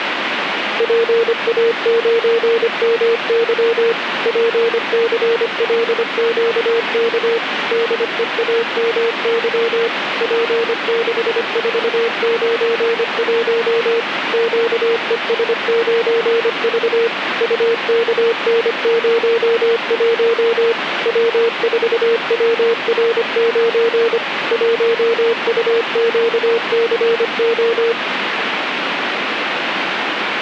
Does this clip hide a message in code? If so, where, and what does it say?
Yes: Morse code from 0.7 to 28.0 s, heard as a keyed tone, machine-sent, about 25 wpm, 460 Hz, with radio static. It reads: PA9MY PCLQK DEAMY P6491 QES9V UKN01 W4WR9 1UQCO